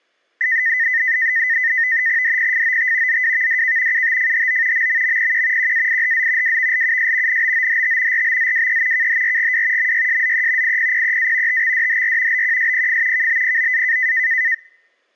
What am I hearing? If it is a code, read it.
NAVTEX (SITOR-B), 100 baud, 170 Hz shift, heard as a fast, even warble, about 1900 Hz centre. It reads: DPFOT ZWVDK UTFHO MMMPQ QAIHZ WVLUS NBOHT RBZWE KHRGW MYSZE IPPEA TXDHR BQSPF KBPOA